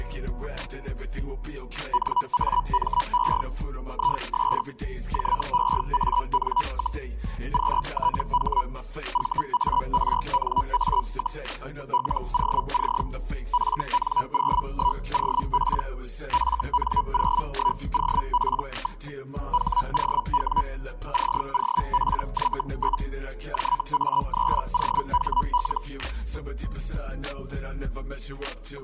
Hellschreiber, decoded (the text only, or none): NAME IS JEAN, QTH VARNA, LOC FN01OP FN01OP. HOW COPY? JA3OHL